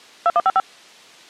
DTMF, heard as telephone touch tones, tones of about 40 ms. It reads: 2155